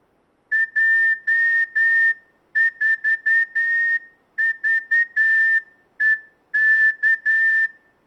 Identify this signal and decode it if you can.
Morse code, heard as a whistle, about 9 wpm, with room echo. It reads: J4VEK